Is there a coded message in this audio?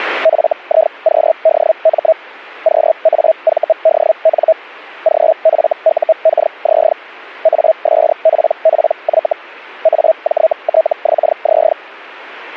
Yes: Hellschreiber (Feld-Hell, 122.5 baud) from 0.2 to 11.7 s, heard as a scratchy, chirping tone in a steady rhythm, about 640 Hz. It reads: FIQDM QAVDN GFUKZ ASPPY AJTXZ